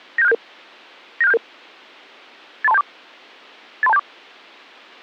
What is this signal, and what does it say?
Five-tone selective call (EIA), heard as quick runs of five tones, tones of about 30 ms. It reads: 97677 97677 83274 83274